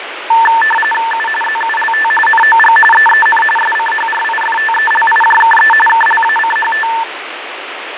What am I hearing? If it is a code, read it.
RTTY (45.45 baud, 850 Hz shift), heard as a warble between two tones, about 1340 Hz centre, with radio static and fading. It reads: U ZULT NOG EEN SCHRIFTELIJKE KLACHT